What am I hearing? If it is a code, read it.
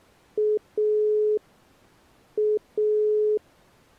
Telephone call progress tone (pulsed, as in Italy), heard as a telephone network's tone, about 420 Hz. Dial tone.